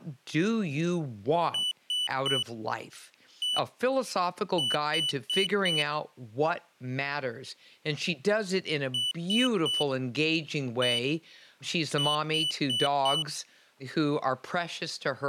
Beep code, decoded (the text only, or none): 3-1-4